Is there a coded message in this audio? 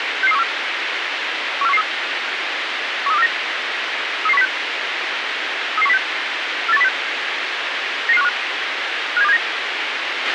Yes: five-tone selective call (EEA) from 0.2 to 9.4 s, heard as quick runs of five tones, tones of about 40 ms, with radio hiss and a squelch burst at the end. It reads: 66314 14113 13249 33106 33106 48106 99515 57279